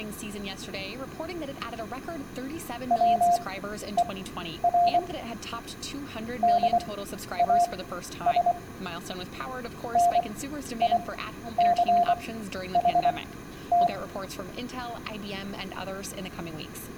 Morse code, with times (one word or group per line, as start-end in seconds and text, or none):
2.9-5.0 WER
6.4-8.5 DAS
10.0-13.9 NICHT